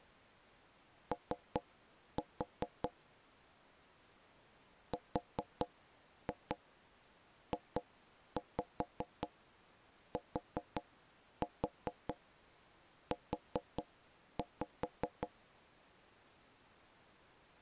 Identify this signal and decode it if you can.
Tap code, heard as knocks on wood, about 5 knocks a second. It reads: O RJTU